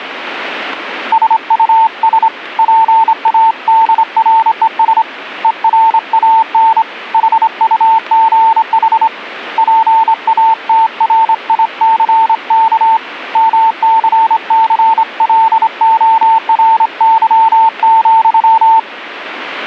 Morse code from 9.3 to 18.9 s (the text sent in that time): PATRICK MCCLORY,